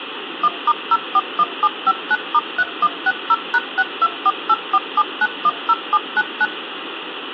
DTMF, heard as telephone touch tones, dialled by machine, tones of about 50 ms, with phone line noise and room echo. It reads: 1*041759*3160#624847910799